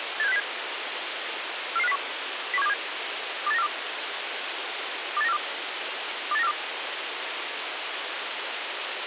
Five-tone selective call (EEA), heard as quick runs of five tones, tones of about 40 ms, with radio hiss. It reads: 87607 44501 01727 28942 28942 28942